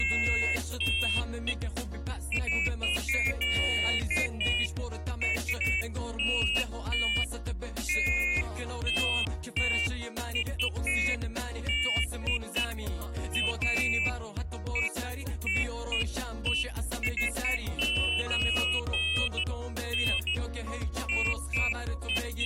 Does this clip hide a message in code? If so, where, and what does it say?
No, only pairs of high tones at irregular times.